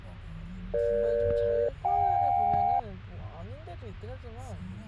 Aircraft SELCAL, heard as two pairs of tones, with the noise inside a car. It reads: EG-JK